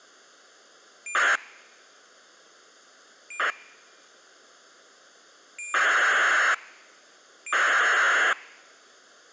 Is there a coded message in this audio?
Yes: ACARS aircraft data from 1.1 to 8.3 s, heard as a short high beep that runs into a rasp, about 2400 baud.